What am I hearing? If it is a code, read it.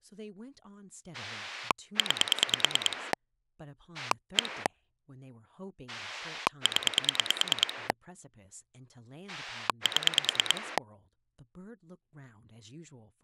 Pulse dialling, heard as a rotary dial, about 9 pulses a second, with speech in English. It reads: 9 1 0 7